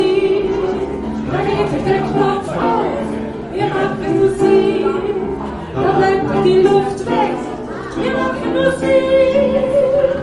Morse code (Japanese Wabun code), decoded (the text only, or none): none